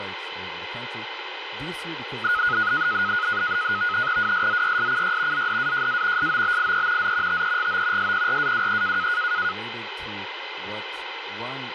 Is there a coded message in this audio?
Yes: NAVTEX (SITOR-B), 100 baud, 170 Hz shift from 2.2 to 9.5 s, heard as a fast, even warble, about 1360 Hz centre, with radio static and speech in English. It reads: WSZYSCY ZDAJA SOBIE Z TEGO SPRAWE